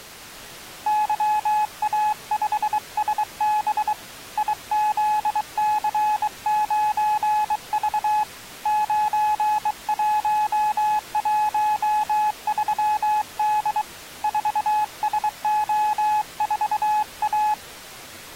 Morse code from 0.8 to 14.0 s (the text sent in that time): YA5SB IZC9V 9113D